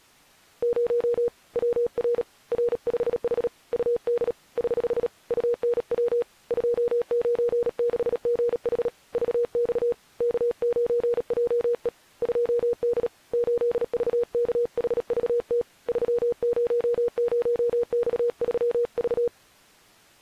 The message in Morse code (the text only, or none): 0 WR R5H UD <HH> UNW 296GH VX K9JE 2D 8VKHVT 300X3V